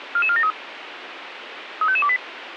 Five-tone selective call (ZVEI), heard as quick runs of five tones, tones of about 70 ms, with radio hiss. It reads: 44473 35528